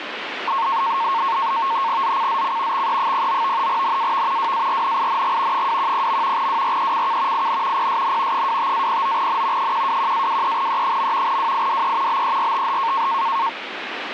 NAVTEX (SITOR-B), 100 baud, 170 Hz shift, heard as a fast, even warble, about 1000 Hz centre, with radio static. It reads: ZCZC XE09 NAV WARNING 210. WRECK IN PSN 25-09N 121-23E. WIDE BERTH